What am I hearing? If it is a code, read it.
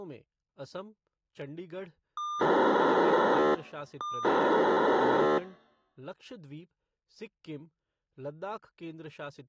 POCSAG pager data (2400 baud), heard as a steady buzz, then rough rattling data, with speech in Hindi.